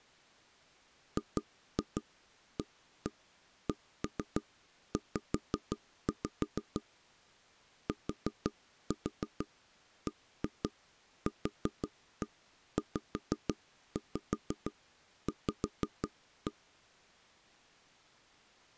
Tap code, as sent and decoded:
2-2 1-1 1-3 5-5 / 4-4 1-2 4-1 5-5 5-1
GACZ TBQZV

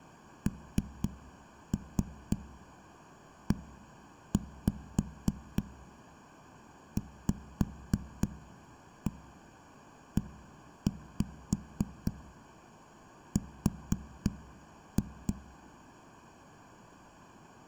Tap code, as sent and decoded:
3-3 1-5 5-1 1-5 4-2
NEVER

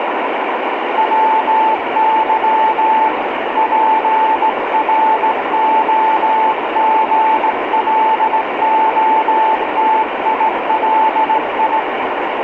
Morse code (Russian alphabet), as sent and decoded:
.-- -.-- / .--. .-. --- --. .-.. --- - .. .-.. ..
ВЫ ПРОГЛОТИЛИ

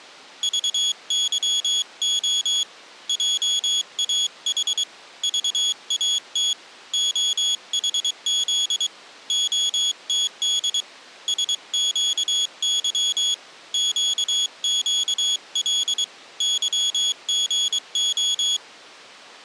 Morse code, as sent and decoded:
...- -.-- --- / .--- .- .... / ...- .- - / --- .... --.. / --- - -.. / ... --.- -.-- / --.- --.- .-.. / -.-- --. ---
VYO JAH VAT OHZ OTD SQY QQL YGO

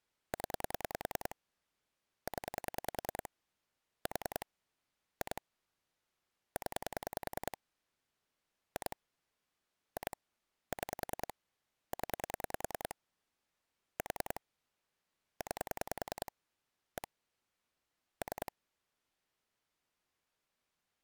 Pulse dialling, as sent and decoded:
10 / 10 / 4 / 2 / 10 / 2 / 2 / 6 / 10 / 4 / 9 / 1 / 3
0 0 4 2 0 2 2 6 0 4 9 1 3

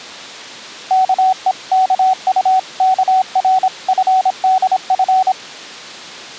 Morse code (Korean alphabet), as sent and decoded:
-.- . -.- ..- -.- .-. ..-. -.. ..-.
아이유는

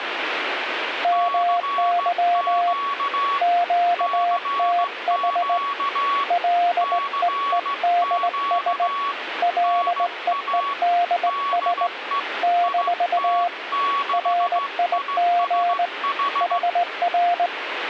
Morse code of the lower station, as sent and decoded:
-- -.-- / --.- - .... / .-.. . . -.. ... / .-.. . . -.. ... / -....- / .-. .. --. / .... .-.
MY QTH LEEDS LEEDS - RIG HR

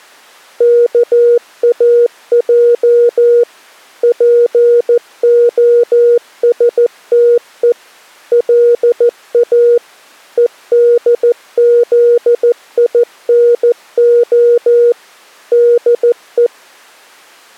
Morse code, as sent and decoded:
-.- .- .--- / .--. --- ... - . / .-.. .- / . -.. --.. .. -. --- / -.. .
KAJ POSTE LA EDZINO DE

